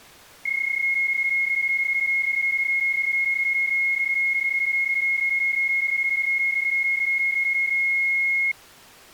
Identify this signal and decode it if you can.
PSK31 (31.25 baud), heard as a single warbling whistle, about 2150 Hz.